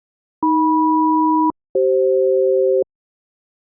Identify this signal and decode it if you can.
Aircraft SELCAL, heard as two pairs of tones. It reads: AM-CF